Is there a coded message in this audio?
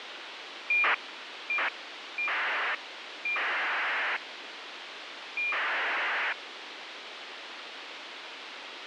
Yes: ACARS aircraft data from 0.7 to 6.3 s, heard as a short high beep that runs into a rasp, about 2400 baud, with radio hiss.